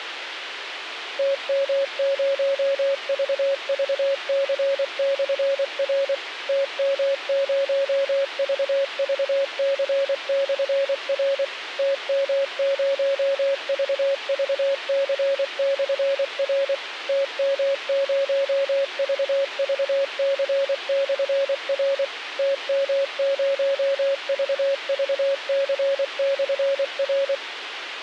Morse code, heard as a keyed tone, machine-sent, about 24 wpm, 550 Hz, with radio hiss. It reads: TM0VVC/R TM0VVC/R TM0VVC/R TM0VVC/R TM0VVC/R